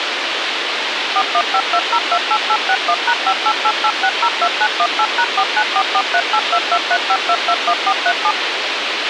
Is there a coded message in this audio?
Yes: DTMF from 1.2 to 8.3 s, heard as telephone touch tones, dialled by machine, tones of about 60 ms, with radio hiss and a squelch burst at the end. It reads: 4152028861#5888602918#4944382235221437